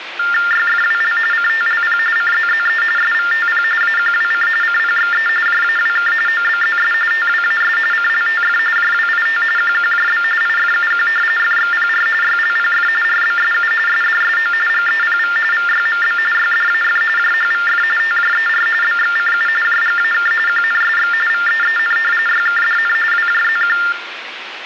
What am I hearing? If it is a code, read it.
TTY/TDD text telephone tones (45.45 baud Baudot), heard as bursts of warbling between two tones, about 400 Hz shift, 1600 Hz centre, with phone line noise. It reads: YFWL CTLP CZZE SVTP AQWC CPXE JAWK OBZS TWAS CLTF JWIT QQJB IFUQ FXPR YLPF RBSU SDSO GEPV VYMB YDAF JHVF TJER BXCU JGAK QNSX VEEN YKDN WJZQ